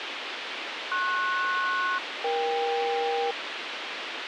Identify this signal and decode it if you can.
Aircraft SELCAL, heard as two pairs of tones, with radio hiss. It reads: PS-EK